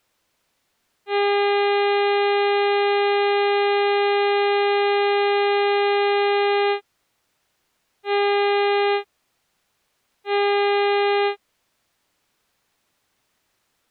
Ship horn signal, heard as a ship's horn, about 400 Hz. 1 long, 2 short. At sea: a vessel in fog that is sailing, fishing, towing or hampered.